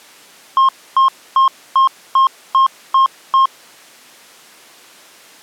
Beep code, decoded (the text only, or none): 8 short